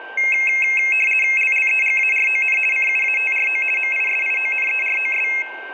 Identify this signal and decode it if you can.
RTTY (50 baud, 450 Hz shift), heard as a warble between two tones, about 2350 Hz centre, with a steady whistle near 1570 Hz and room echo. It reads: LLEGARON CUATRO MISIONEROS